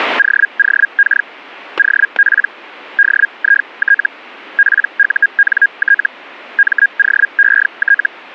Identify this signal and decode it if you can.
Hellschreiber (Feld-Hell, 122.5 baud), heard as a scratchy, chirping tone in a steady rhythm, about 1650 Hz, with static crashes. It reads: OOK OP DIT PUNT MOET